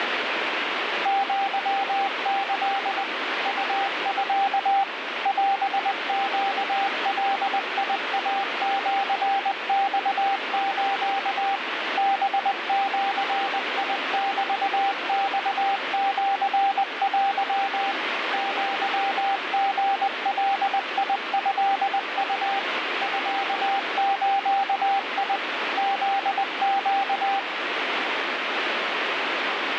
Morse code (Japanese Wabun code), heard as a keyed tone, machine-sent, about 20 wpm, 790 Hz, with heavy radio static. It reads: アキ ウミ オネガイシマス ハジメマシテ アリガトウ ミズ フネ